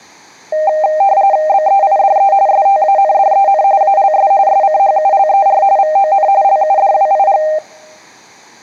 RTTY (45.45 baud, 170 Hz shift), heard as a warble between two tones, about 700 Hz centre. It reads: BEIDE STANDEN ALS SCHULER VON LUDWIG